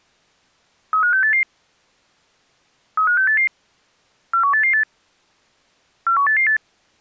Five-tone selective call (CCIR), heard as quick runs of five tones, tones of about 100 ms. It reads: 35688 35688 41888 41888